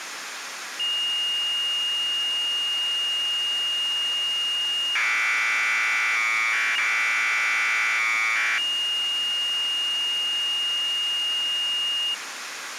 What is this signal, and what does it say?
Commodore tape loading (standard loader), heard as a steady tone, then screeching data, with tape hiss.